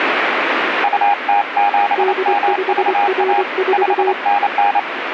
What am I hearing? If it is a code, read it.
Morse code, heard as two keyed tones, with radio static. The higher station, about 28 wpm, 810 Hz: UT7MVA 5NN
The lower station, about 24 wpm, 380 Hz: D5R4